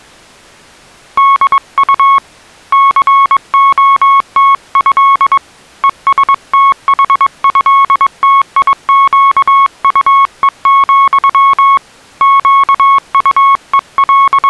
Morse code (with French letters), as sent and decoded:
-.. ..- / -.-. --- - ..-.. / . ... - .... ..-.. - .. --.- ..- . --..-- / …
DU COTÉ ESTHÉTIQUE, …

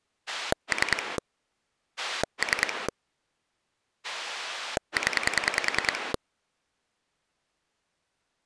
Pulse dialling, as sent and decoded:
3 / 3 / 10
3 3 0

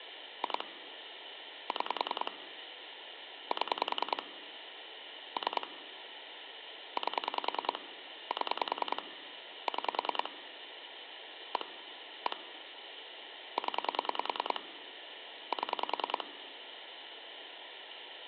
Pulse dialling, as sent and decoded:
2 / 6 / 7 / 3 / 8 / 7 / 6 / 1 / 1 / 10 / 7
2 6 7 3 8 7 6 1 1 0 7

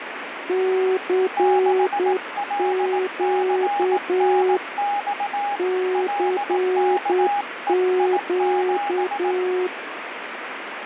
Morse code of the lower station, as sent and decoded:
-.-. --.- / -.-. --.-
CQ CQ

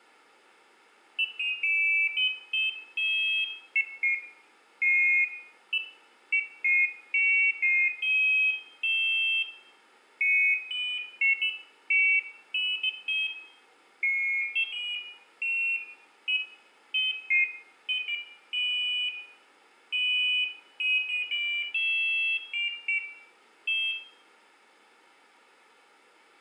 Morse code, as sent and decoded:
none

